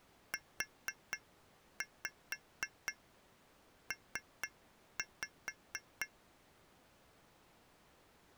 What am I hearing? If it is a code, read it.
Tap code, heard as taps on glass, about 4 knocks a second. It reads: UP